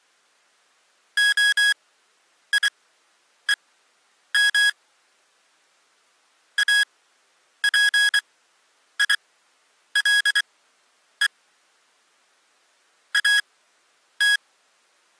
Morse code (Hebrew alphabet), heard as electronic beeps, machine-sent, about 24 wpm, spaced as for 9 wpm, 1650 Hz. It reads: היום אפילו את